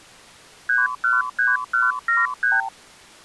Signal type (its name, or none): multi-frequency trunk signalling